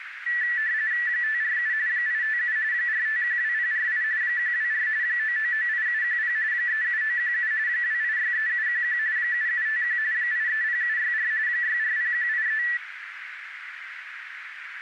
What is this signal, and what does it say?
RTTY (45.45 baud, 170 Hz shift), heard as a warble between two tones, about 1850 Hz centre, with radio static and a narrow filter. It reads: 547 857 4512048 124 9998710 37917 2863711 7751 830764 640183